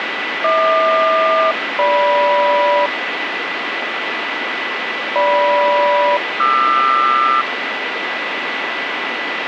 Aircraft SELCAL, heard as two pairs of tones, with radio static and a steady whistle near 1990 Hz. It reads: HQ-GM GM-QR